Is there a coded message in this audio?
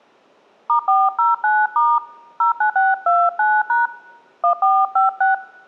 Yes: DTMF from 0.7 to 5.3 s, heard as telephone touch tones, dialled by hand, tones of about 160 ms. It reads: *409* 09629# 1456